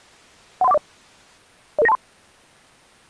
Five-tone selective call (EIA), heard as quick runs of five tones, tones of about 30 ms. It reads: 13140 00923